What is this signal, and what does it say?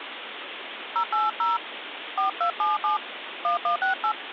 DTMF, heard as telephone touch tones, dialled by hand, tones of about 130 ms, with phone line noise. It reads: 080 4277 1168